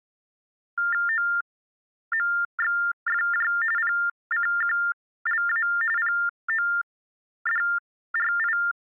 TTY/TDD text telephone tones (45.45 baud Baudot), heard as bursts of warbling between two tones, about 400 Hz shift, 1600 Hz centre. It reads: OMXFJ PCQLA PODRI